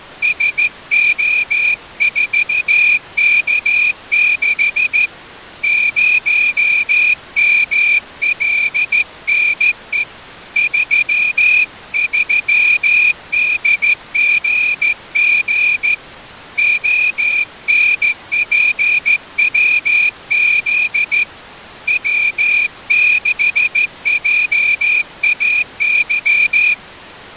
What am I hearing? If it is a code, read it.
Morse code, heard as a whistle, hand-sent with a straight key, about 14 wpm. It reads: SO4K6 0MLNE 33DGG ONPWZ W6JAY